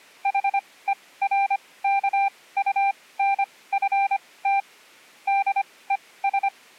Morse code, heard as a keyed tone, machine-sent, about 25 wpm, spaced as for 18 wpm, 790 Hz. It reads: HERKUNFT DES